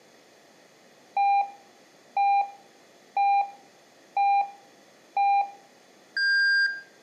Radio time signal (five pips and a higher one, as on Chinese radio), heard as pips, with room echo.